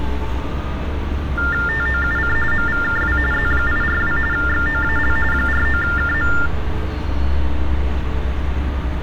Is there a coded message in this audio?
Yes: TTY/TDD text telephone tones (45.45 baud Baudot) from 1.4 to 6.5 s, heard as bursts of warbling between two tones, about 400 Hz shift, 1600 Hz centre, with room echo and street noise. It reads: TOUC MVKW Z842 XOAL 49KM